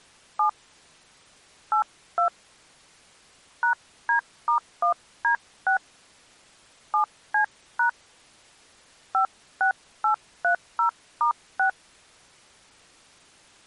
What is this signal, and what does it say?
DTMF, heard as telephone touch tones, dialled by hand, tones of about 100 ms. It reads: 7 82 #D*1D6 7C# 56830*6